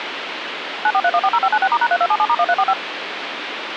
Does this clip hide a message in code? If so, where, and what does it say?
Yes: DTMF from 0.8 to 2.7 s, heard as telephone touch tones, dialled by machine, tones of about 60 ms, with phone line noise. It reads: 943140596*#3277*1345